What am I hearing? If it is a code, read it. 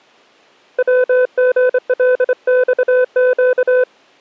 Morse code (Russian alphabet), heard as a keyed tone, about 25 wpm, 500 Hz. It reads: ВГЛЬЩ